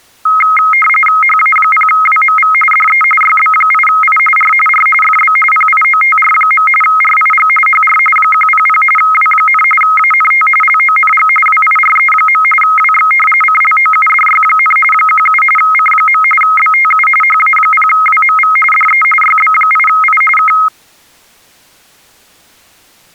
RTTY (45.45 baud, 850 Hz shift), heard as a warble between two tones, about 1700 Hz centre. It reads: HA0WMV DE YB8I R R FB PIOTR. RIG HR 100 W, ANT LONG WIRE. WX CLOUDY, 17 C. BTU HA0WMV DE YB8I K